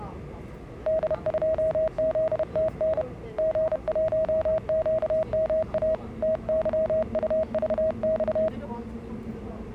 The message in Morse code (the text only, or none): D2ZTN G1QMA TYUVX